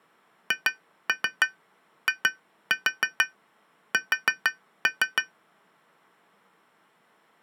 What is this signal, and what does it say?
Tap code, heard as taps on glass, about 6 knocks a second. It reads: HIS